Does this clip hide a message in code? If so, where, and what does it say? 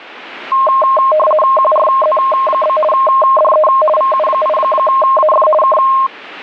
Yes: RTTY (50 baud, 450 Hz shift) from 0.5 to 6.1 s, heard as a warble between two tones, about 840 Hz centre. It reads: QRZ? DE VU8AF K